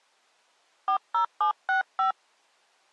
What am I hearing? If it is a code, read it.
DTMF, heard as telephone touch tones, dialled by hand, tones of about 110 ms. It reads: 40765